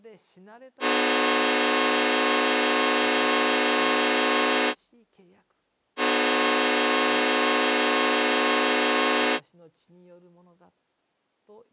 Train horn signal, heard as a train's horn, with speech in Japanese. 2 long. On North American railways: brakes released, proceed.